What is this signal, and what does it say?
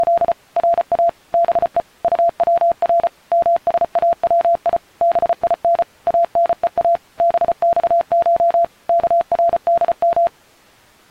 Morse code (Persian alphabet), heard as a keyed tone, machine-sent, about 34 wpm, 680 Hz. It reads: … را به طور مساوی بین انها بخش کردم